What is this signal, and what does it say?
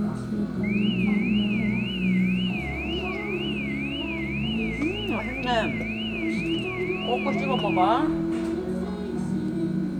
A tone that sweeps in pitch again and again, with room echo and the noise of a restaurant. There is no code.